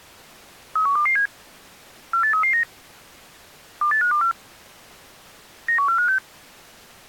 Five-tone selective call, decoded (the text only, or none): 31227 48339 28524 91456